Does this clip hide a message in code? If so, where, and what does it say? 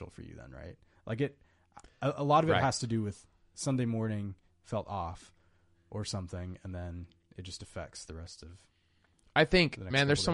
No, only speech in English.